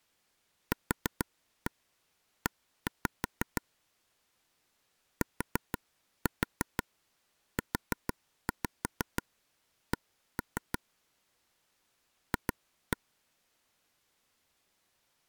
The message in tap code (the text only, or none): QE TUC F